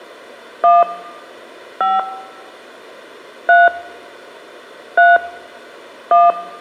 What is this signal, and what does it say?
DTMF, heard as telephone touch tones, dialled by hand, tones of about 190 ms, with room echo. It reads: 1 5 3 3 1